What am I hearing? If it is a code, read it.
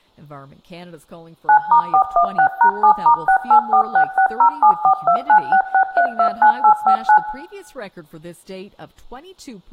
DTMF, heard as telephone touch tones, dialled by machine, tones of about 90 ms, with room echo and speech in English. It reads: 9*416#7*684660742966329859